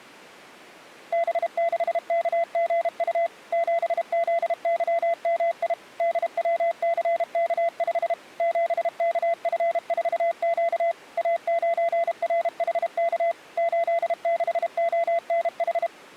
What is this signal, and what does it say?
Morse code, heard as a keyed tone, machine-sent, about 32 wpm, 680 Hz. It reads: B6KGU 7ZYMI DWCK5 7KF4Q A9RHK 86ONH